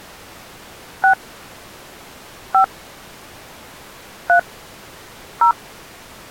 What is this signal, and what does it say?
DTMF, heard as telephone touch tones, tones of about 100 ms. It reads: 6 5 3 0